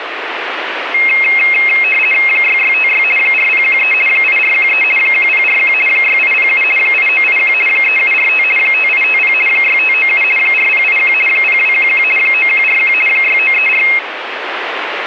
RTTY (50 baud, 450 Hz shift), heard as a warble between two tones, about 2350 Hz centre, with radio static. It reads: 6656 4013 8413 1041 6807 8981 3745 5850 6597 4081 0211 9141 6934